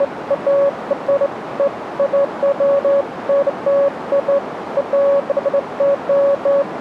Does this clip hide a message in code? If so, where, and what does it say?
No, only beeps of irregular length, with radio static and a narrow filter.